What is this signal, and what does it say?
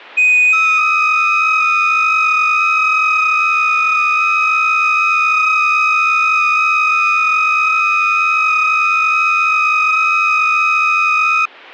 FT8 (several signals at once), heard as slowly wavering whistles, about 6.25 baud.